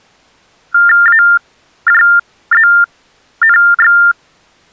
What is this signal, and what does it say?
TTY/TDD text telephone tones (45.45 baud Baudot), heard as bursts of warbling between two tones, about 400 Hz shift, 1600 Hz centre. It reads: AJZNX